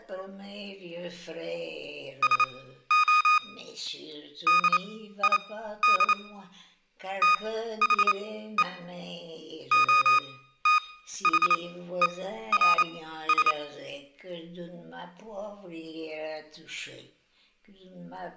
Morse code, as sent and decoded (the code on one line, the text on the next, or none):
... --- / -.. .. -.. / - .... . / --- - .... . .-. ...
SO DID THE OTHERS